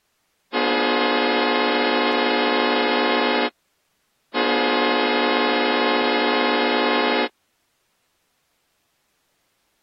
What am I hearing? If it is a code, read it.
Train horn signal, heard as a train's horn. 2 long. On North American railways: brakes released, proceed.